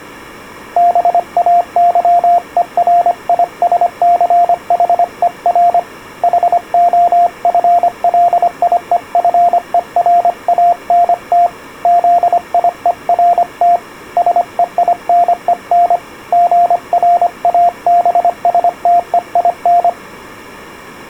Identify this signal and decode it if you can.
Morse code, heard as a keyed tone, hand-sent with a paddle, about 25 wpm, 700 Hz. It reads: BAYERISCHER HOFLIEFERANT ZIERT SEINEN GRABSTEIN